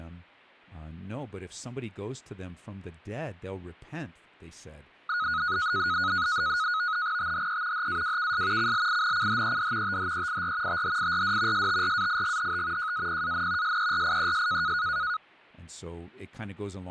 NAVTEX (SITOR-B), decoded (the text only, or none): THE HAWKS CLINCHED THEIR THIRD STRAIGHT JAPAN SERIES